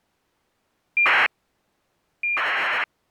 ACARS aircraft data, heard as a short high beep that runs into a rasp, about 2400 baud.